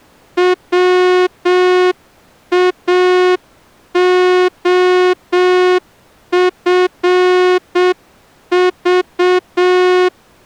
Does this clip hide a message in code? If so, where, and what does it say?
Yes: Morse code (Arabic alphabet) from 0.3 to 10.1 s, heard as a horn, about 7 wpm. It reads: واخفض